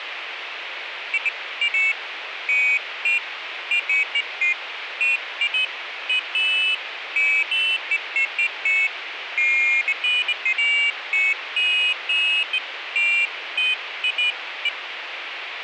Pairs of high tones at irregular times, with phone line noise. There is no code.